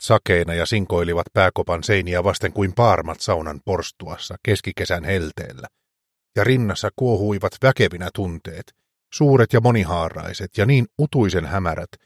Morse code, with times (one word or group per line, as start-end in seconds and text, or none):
none